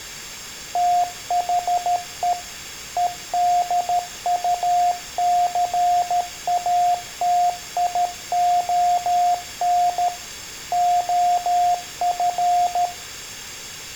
Morse code, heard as a keyed tone, machine-sent, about 13 wpm, 710 Hz, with room echo. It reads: THE EDUCATION OF